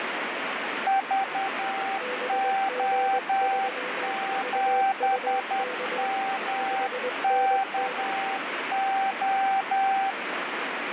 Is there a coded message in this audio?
Yes: Morse code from 0.8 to 10.2 s, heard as two keyed tones, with heavy radio static. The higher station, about 10 wpm, 780 Hz: VO7MKO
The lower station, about 21 wpm, 500 Hz: BG3VUK 5NN